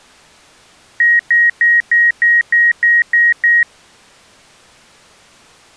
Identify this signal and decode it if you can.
Beep code, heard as beeps, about 1900 Hz. 9 short. In AMI BIOS tables: ROM checksum failure.